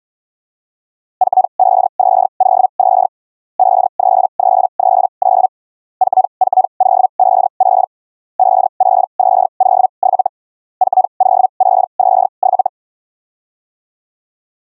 Hellschreiber (Feld-Hell, 122.5 baud), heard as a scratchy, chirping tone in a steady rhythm, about 750 Hz. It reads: 45202 53339 44056 56207 40627